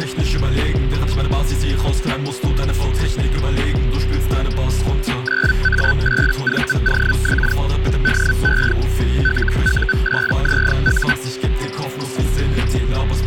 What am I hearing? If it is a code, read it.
Hellschreiber (Feld-Hell, 122.5 baud), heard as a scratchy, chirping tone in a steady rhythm, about 1500 Hz, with a steady whistle near 380 Hz. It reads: 9A8VOX DE LU8ZU